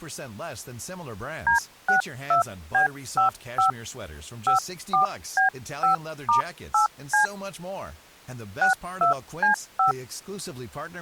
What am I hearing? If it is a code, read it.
DTMF, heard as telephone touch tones, dialled by hand, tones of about 120 ms, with speech in French. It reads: D62B55 54B5*8C 62C5